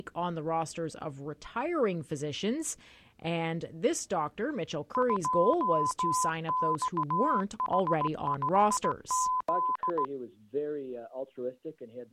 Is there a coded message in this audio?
Yes: Morse code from 4.9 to 10.1 s, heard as a keyed tone, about 17 wpm, 1010 Hz. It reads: 2XH5Z